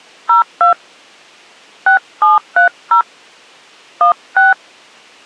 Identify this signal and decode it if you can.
DTMF, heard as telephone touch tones, dialled by hand, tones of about 130 ms. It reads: 02 6730 16